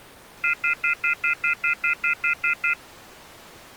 Telephone call progress tone (North American plan), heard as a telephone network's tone, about 1400, 2050, 2450, 2600 Hz, 0.1 s on and 0.1 s off. Off-hook warning tone.